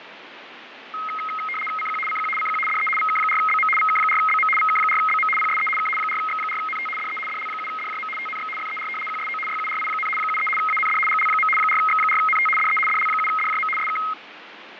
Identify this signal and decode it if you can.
RTTY (75 baud, 850 Hz shift), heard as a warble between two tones, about 1700 Hz centre, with radio static and fading. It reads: CQ CQ CQ DE VK4BM VK4BM VK4BM PSE K 4X4NT DE DL7DJM TNX FER QSO YURI, 73 AND GL. 4X4NT DE DL7DJM SK